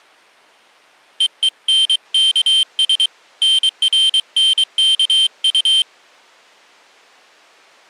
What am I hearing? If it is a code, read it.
Morse code, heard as a high beeper, hand-sent with a paddle, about 23 wpm, 3150 Hz. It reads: EENKS NRNKU